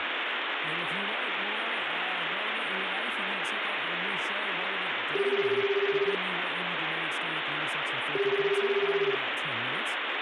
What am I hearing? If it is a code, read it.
Telephone call progress tone (Japanese plan), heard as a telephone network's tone, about 380, 400, 420 Hz, 1 s on and 2 s off, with phone line noise and speech in English. Ringback tone.